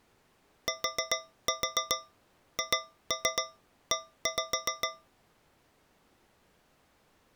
Tap code, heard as taps on a metal pipe, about 7 knocks a second. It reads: THE